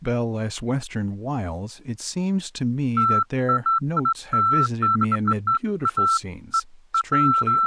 Beeps of irregular length, with speech in English. There is no code.